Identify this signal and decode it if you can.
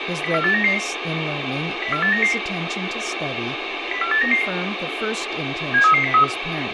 Five-tone selective call (CCIR), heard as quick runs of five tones, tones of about 100 ms, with radio hiss, room echo and speech in English. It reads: 04899 04899 04899 73303